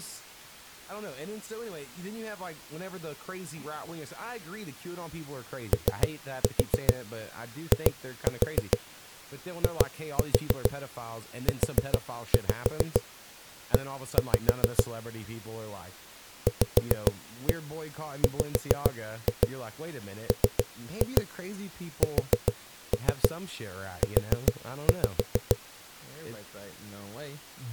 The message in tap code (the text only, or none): OIIUE VWMSU